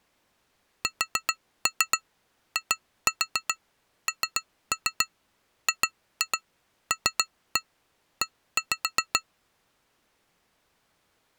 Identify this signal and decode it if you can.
Tap code, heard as taps on glass, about 7 knocks a second. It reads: SINGLE